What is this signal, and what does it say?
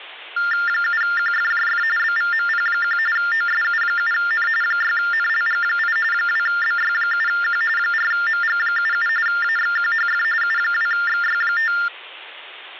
TTY/TDD text telephone tones (45.45 baud Baudot), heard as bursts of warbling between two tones, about 400 Hz shift, 1600 Hz centre. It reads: 7QFJF BVMP1 OSU7N 6NLG8 2BY7Q 4MG77 AXQHF U2XY5